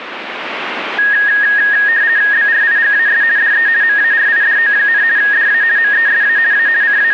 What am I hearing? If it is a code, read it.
RTTY (50 baud, 170 Hz shift), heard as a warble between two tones, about 1750 Hz centre, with radio static. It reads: BRIGAS DE MARIDO, DA MESA A …